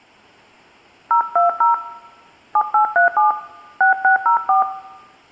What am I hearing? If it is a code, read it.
DTMF, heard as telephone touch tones, dialled by hand, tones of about 100 ms, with room echo. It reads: 020 7837 6604